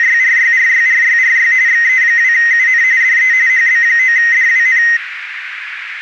RTTY (45.45 baud, 170 Hz shift), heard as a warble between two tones, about 1950 Hz centre, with radio static and a narrow filter. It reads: … XE2UN DE HB9DWN